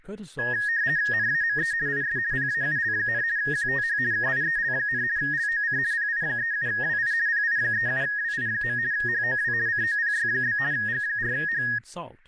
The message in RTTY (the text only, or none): NAME IS PAUL, QTH KIEL, LOC PI37WI PI37WI. HOW COPY? G4H